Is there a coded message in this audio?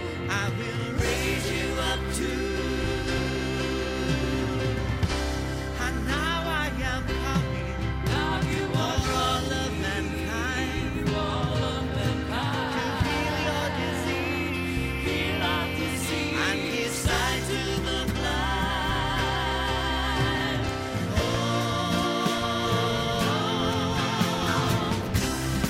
No.